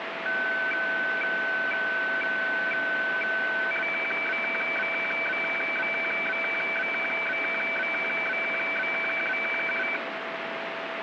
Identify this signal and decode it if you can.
Weather fax (radiofax), 120 lines a minute, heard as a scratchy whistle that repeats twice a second, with radio static.